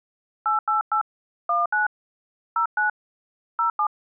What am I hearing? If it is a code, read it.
DTMF, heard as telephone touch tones, dialled by hand, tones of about 120 ms. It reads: 888 19 09 07